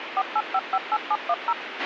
DTMF, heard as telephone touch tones, dialled by machine, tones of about 50 ms, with radio hiss and a squelch burst at the end. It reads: 48558710